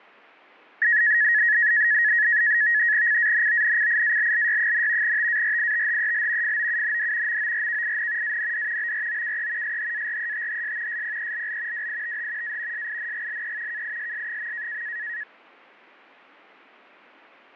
NAVTEX (SITOR-B), 100 baud, 170 Hz shift, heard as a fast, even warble, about 1800 Hz centre, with fading. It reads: CANONCIALLY, TARITHEL FOUND MORKIN AND BROKE SHARETHS SPELL WITH A SINGLE KISS.